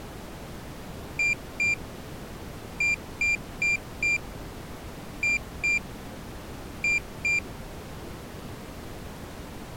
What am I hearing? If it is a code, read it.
Beep code, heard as a piezo beeper, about 2400 Hz. 2-4-2-2.